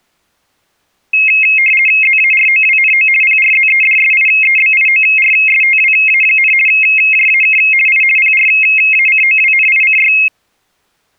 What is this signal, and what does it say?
RTTY (50 baud, 450 Hz shift), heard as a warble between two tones, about 2350 Hz centre. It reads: ZAROWNO PRZEDSIEBIORSTWA, JAK I PRACOWNICY